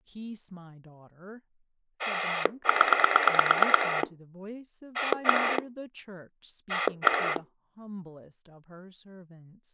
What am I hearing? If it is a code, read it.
Pulse dialling, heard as a rotary dial, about 9 pulses a second, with speech in English. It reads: 0 1 1